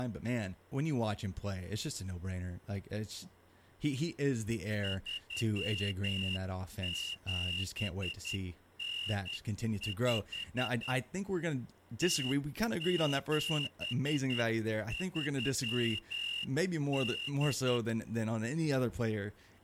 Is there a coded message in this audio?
Yes: Morse code (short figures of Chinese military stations) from 4.8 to 17.8 s, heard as a whistle, hand-sent with a straight key, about 10 wpm, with speech in English. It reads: 3795 0738